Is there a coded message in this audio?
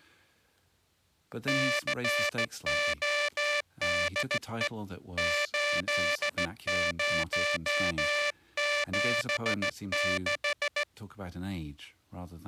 Yes: Morse code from 1.4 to 10.9 s, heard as a buzzer, hand-sent with a straight key, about 15 wpm. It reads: CODE 8076